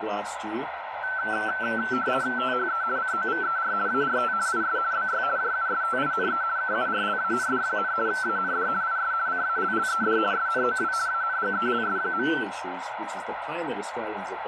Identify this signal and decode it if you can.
RTTY (50 baud, 170 Hz shift), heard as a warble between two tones, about 1430 Hz centre, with radio static. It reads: THE COVER ART IS BY JUSTINE KURLAND, AND IS CALLED SNOW ANGELS.